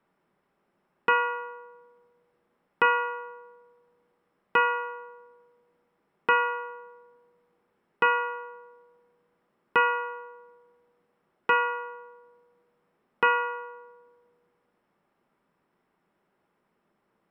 Clock strike, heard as a bell. 8. Eight o'clock.